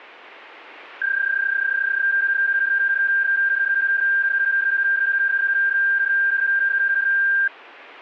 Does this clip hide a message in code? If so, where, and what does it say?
Yes: PSK31 (31.25 baud) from 1.0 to 7.5 s, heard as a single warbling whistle, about 1600 Hz.